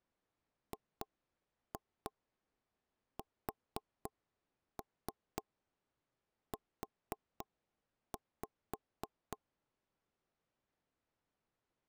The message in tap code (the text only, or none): GSU